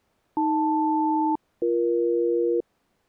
Aircraft SELCAL, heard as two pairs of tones. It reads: AL-BE